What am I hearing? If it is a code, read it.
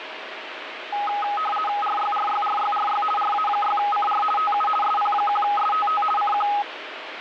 RTTY (50 baud, 450 Hz shift), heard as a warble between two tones, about 1040 Hz centre, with radio static. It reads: RYRYRYRY RA6CR TU SP1STT CQ